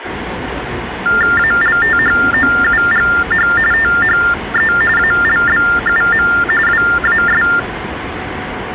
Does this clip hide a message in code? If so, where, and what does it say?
Yes: TTY/TDD text telephone tones (45.45 baud Baudot) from 1.1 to 7.6 s, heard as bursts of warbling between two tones, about 400 Hz shift, 1600 Hz centre, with phone line noise and the noise of a subway station. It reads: ALTHOUGH THE ALBUM WAS